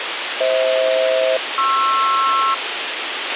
Aircraft SELCAL, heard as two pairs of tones, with radio hiss and a squelch burst at the end. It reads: FH-PR